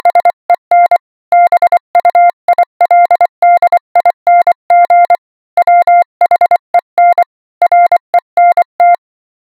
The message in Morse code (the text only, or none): … BUILDING WHEN RENT